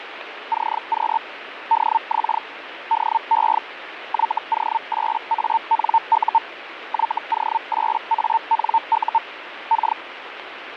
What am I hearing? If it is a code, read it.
Hellschreiber (Feld-Hell, 122.5 baud), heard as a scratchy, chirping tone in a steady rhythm, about 900 Hz, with radio static. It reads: CQ DX DE YO8ANU YO8ANU K